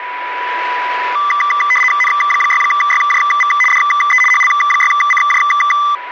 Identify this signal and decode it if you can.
RTTY (75 baud, 850 Hz shift), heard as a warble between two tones, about 1600 Hz centre, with radio static and a steady whistle near 980 Hz. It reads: N6YJV DE HL6CJ